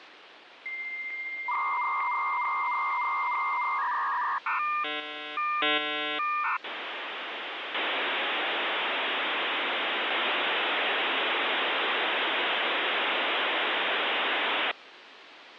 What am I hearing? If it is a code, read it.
Dial-up modem handshake (V.34 or later), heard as a whistle, warbles, then hiss, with phone line noise.